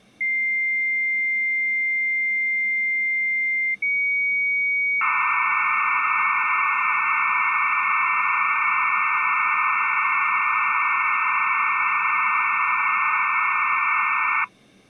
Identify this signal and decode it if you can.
Dial-up modem handshake (low-speed, two carriers), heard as two whistles, then hiss.